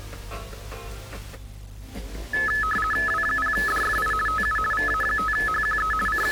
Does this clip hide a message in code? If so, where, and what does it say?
Yes: RTTY (50 baud, 450 Hz shift) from 2.3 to 6.3 s, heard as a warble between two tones, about 1500 Hz centre. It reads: W0DFI TU VA5HQE …